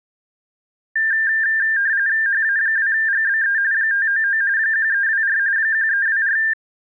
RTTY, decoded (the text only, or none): HA2GBE 599 1324 1324